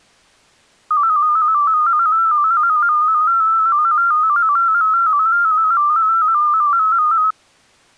Multi-tone FSK (Olivia or MFSK type), about 250 Hz wide, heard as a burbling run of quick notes, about 15.625 baud.